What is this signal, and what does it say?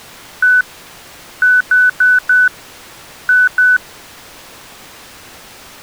Beep code, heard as beeps, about 1500 Hz. 1-4-2. In Phoenix BIOS tables: parity failure in the first 64 KB of memory.